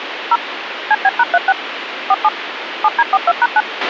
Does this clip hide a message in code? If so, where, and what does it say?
Yes: DTMF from 0.3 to 3.6 s, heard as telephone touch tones, dialled by machine, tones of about 40 ms, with radio hiss and a squelch burst at the end. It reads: 0 CB#36 47 7D42#9